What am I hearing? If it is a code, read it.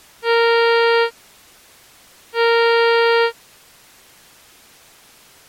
Ship horn signal, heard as a ship's horn, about 460 Hz. 2 short. At sea: I am altering course to port.